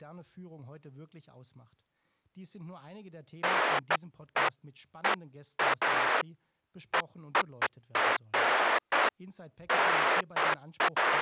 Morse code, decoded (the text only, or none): none